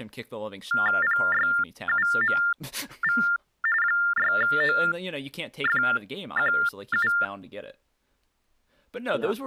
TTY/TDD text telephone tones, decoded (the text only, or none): PYUMV 6OFQU